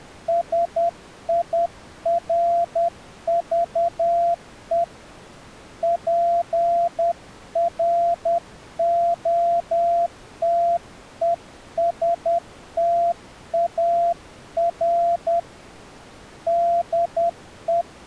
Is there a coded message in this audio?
Yes: Morse code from 0.2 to 17.9 s, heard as a keyed tone, hand-sent with a paddle, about 10 wpm, 690 Hz. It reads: SIRVE PROTESTAR DE